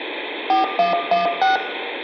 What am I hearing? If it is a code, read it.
DTMF, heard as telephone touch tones, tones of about 140 ms, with phone line noise and room echo. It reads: 4116